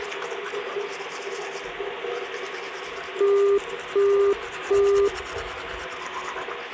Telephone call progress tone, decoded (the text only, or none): busy tone